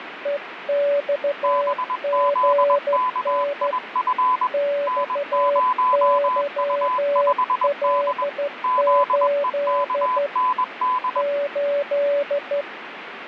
Morse code, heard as two keyed tones, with radio static. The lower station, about 13 wpm, 570 Hz: EXGN XYL8 8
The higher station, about 21 wpm, 1010 Hz: BZKIF N0U5D ZEKND